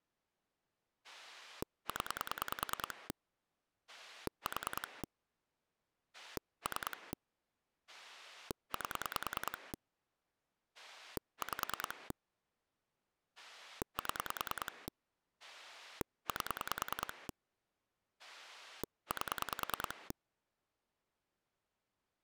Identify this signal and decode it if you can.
Pulse dialling, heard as a rotary dial, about 10 pulses a second. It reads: 0 4 3 8 5 7 8 8